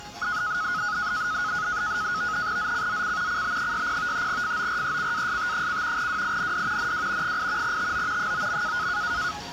NAVTEX (SITOR-B), 100 baud, 170 Hz shift, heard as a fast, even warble, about 1360 Hz centre, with the noise of a park. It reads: ZCZC CB60 FORECAST: WIND NW 8 TO 9.